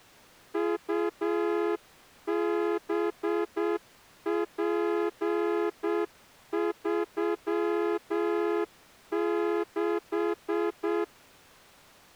Morse code, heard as a horn, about 7 wpm. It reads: UBP36